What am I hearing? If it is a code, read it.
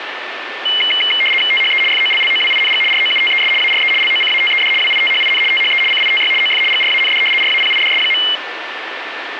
RTTY (75 baud, 850 Hz shift), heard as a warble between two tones, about 2550 Hz centre, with radio static. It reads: THE FOLLOWING ROUTES ARE LOCATED WITHIN THE CITY OF GRAND RAPIDS.